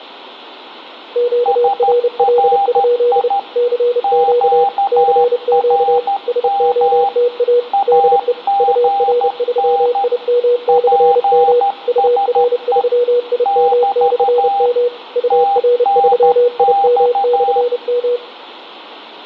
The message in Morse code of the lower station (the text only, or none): QRL? CQ CQ SOTA DE UR3IM/M UR3IM/M UR3IM/M